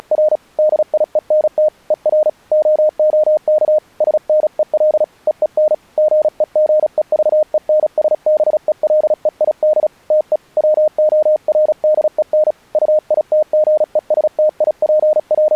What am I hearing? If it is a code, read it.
Morse code, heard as a keyed tone, hand-sent with a paddle, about 36 wpm, 610 Hz. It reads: … DIENT ER OOK SNEL EEN GEGEVENSBELEID TE WORDEN …